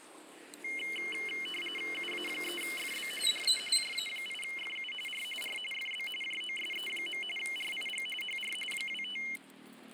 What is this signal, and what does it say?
RTTY (45.45 baud, 850 Hz shift), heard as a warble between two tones, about 2550 Hz centre, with radio static and the noise of a residential street. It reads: UA3FB DE JA8FU R R FB JOSE. RIG HR 25